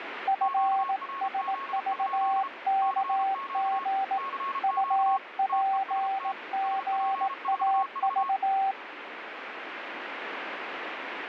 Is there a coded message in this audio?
Yes: Morse code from 0.2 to 8.8 s, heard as two keyed tones, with radio static. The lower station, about 18 wpm, 780 Hz: FSVKG UPGAV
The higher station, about 33 wpm, 1090 Hz: QRZ? CQ CQ TEST SP4V